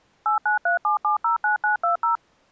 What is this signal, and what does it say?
DTMF, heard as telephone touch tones, dialled by machine, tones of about 120 ms. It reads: 8937709920